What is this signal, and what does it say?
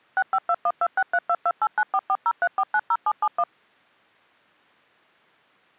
DTMF, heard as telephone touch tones, dialled by machine, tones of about 50 ms. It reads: 652126322894403490771